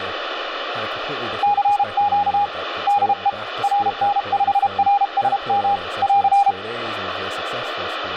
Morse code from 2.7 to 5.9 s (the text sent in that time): DE RN5RSM